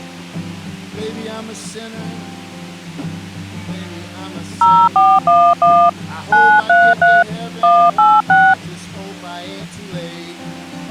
DTMF, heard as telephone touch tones, dialled by hand, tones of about 240 ms. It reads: 0411 933 186